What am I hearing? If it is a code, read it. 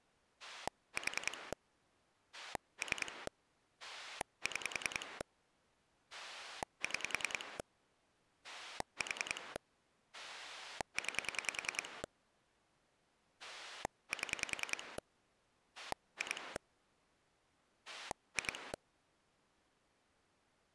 Pulse dialling, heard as a rotary dial, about 10 pulses a second. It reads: 4 3 6 6 4 9 7 2 2